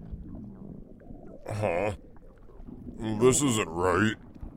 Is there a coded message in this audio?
No.